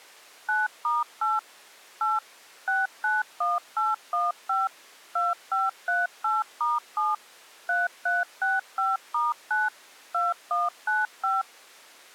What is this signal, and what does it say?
DTMF, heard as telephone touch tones, dialled by machine, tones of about 180 ms. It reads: 9*8 8 691815 2538*7 3365*9 2195